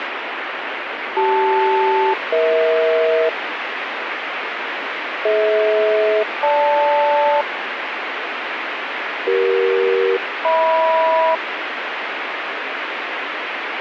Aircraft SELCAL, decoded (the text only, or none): CL-EH DH-GL CE-HM